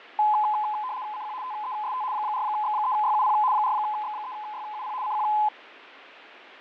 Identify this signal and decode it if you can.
RTTY (75 baud, 170 Hz shift), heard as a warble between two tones, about 930 Hz centre, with radio static and fading. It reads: CQ TEST 4X3YUP 4X3YUP CQ